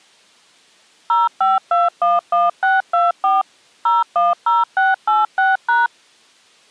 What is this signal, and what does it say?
DTMF, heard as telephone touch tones, dialled by machine, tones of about 180 ms. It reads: 05211624 010686#